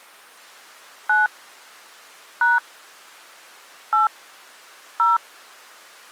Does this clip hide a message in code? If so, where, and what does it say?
Yes: DTMF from 1.1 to 5.2 s, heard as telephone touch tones, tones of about 170 ms. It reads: 9 # 8 0